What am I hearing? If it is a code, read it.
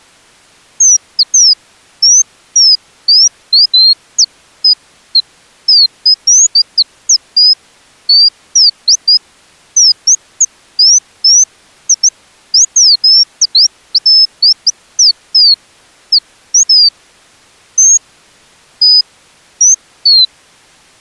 Bird-like chirps. There is no code.